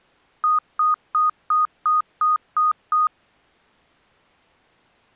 Beep code, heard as beeps, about 1240 Hz. 8 short. In AMI BIOS tables: display memory failure; in Dell tables: LCD failure.